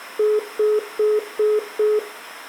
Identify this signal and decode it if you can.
Telephone call progress tone (single-tone plan, as in most of Europe), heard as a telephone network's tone, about 420 Hz, 0.2 s on and 0.2 s off. Congestion tone.